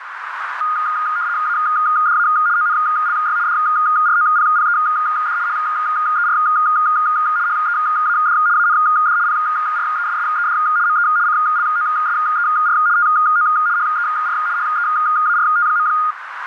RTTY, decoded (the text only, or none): ADA ONLY DROPPED HER HEAD AND PRESSED ME CLOSER TO HER HEART.